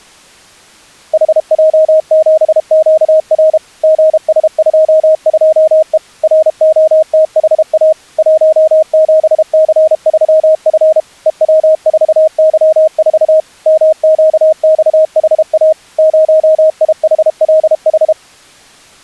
Morse code, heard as a keyed tone, machine-sent, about 32 wpm, 630 Hz. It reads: HJ7QR GS22E ROTHA 17C3F EW4Y4 MQXHA 0IHLH